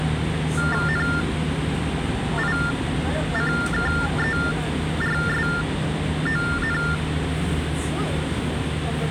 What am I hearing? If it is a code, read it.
TTY/TDD text telephone tones (45.45 baud Baudot), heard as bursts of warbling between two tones, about 400 Hz shift, 1600 Hz centre, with phone line noise and the noise inside a subway train. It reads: NICKERSON